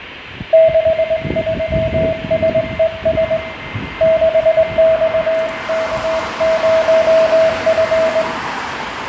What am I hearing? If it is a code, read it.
Morse code, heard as a keyed tone, hand-sent with a straight key, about 20 wpm, 650 Hz, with fading, a weaker station near 2090 Hz, room echo and street noise. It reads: 63SES 6XK0F